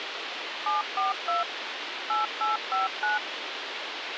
DTMF, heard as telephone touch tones, dialled by machine, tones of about 150 ms, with radio hiss. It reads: 742 8859